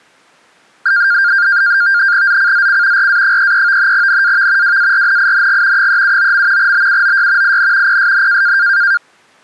NAVTEX (SITOR-B), 100 baud, 170 Hz shift, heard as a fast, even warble, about 1500 Hz centre. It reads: ZCZC RA33 NAV WARNING 379. BUOY IN PSN